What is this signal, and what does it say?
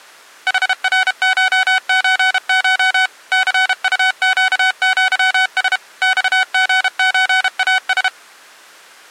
Morse code (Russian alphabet), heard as electronic beeps, machine-sent, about 32 wpm, 750 Hz. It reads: ХРШЧШ ЦУЩЪС ЬГЧАС